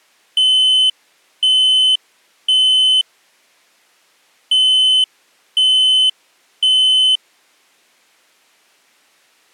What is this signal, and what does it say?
Alarm pattern, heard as an alarm's beeps, played twice, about 3050 Hz. Temporal three. Smoke or fire, evacuate.